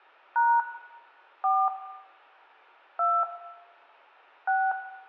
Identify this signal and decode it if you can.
DTMF, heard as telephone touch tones, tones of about 240 ms, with room echo. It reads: # 4 2 6